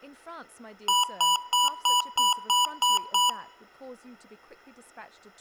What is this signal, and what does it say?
Beep code, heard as beeps from a small speaker, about 980 Hz, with room echo and speech in English. 8 short. In AMI BIOS tables: display memory failure; in Dell tables: LCD failure.